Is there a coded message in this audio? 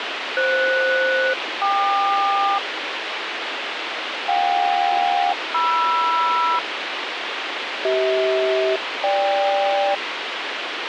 Yes: aircraft SELCAL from 0.4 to 9.9 s, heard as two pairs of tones, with radio hiss. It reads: FS-KQ JK-MR CH-GK